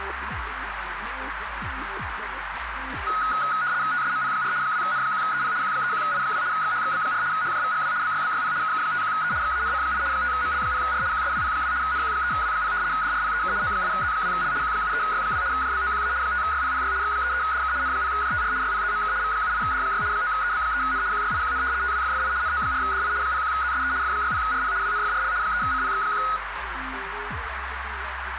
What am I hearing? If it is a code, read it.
RTTY (75 baud, 170 Hz shift), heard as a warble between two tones, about 1360 Hz centre, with radio static and a narrow filter. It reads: TSMP4 2N1EP Q31I2 XHXB4 HJVGW BYBYP KK51E XANC8 5ML0R QSWP2 NQ3W0 DRPEK O8Z2L Q73Y2 JBOQA 5YPPY X33DK N0JTR YPZMK V78D6 9EB3N QYIQN TWFFI NO4DI 01ZSE F60RP WNFRL 3CPX1